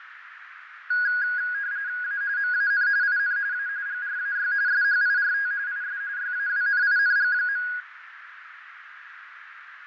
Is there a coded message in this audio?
Yes: RTTY (45.45 baud, 170 Hz shift) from 0.9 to 7.8 s, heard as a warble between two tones, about 1550 Hz centre, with radio static, fading and a narrow filter. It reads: A MAN IN A GRAY SHIRT IS YAWNING.